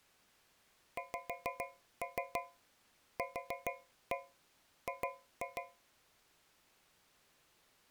Tap code, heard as taps on a metal pipe, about 6 knocks a second. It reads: XQG